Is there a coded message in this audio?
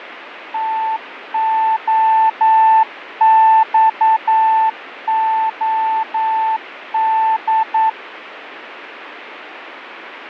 Yes: Morse code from 0.5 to 8.0 s, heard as a keyed tone, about 9 wpm, 880 Hz, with radio static and fading. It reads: TOXOD